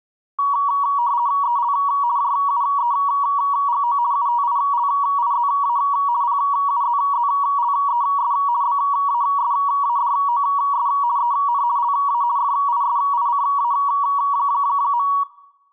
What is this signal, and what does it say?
RTTY (50 baud, 170 Hz shift), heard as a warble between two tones, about 1040 Hz centre, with room echo. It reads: EL JUEGO UTILIZA PUZZLES BASADOS EN LA FISICA.